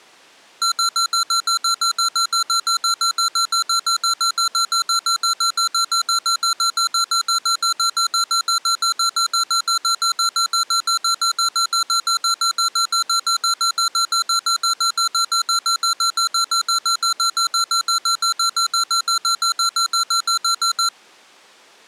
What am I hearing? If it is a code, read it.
Evenly repeated beeps. There is no code.